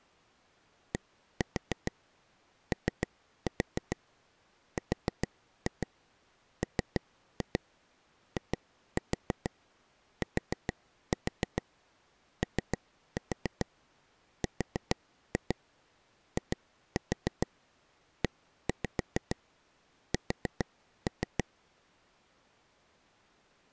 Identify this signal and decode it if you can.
Tap code, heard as taps on a table, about 6 knocks a second. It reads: DORMITORIES